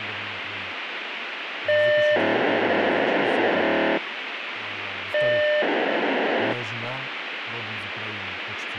POCSAG pager data (1200 baud), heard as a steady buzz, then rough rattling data, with radio hiss and speech in Russian.